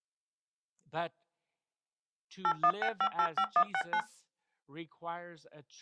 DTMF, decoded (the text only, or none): 816585169